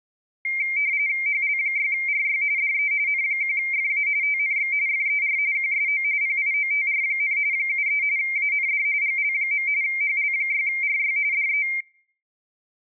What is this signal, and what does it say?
RTTY (45.45 baud, 170 Hz shift), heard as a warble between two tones, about 2200 Hz centre. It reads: HL6RY DE N1FA TNX FER QSO PIOTR, 73 AND GL. HL6RY DE